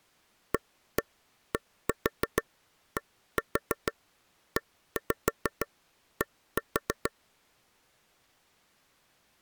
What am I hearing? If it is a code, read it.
Tap code, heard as taps on a table, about 6 knocks a second. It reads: ADDED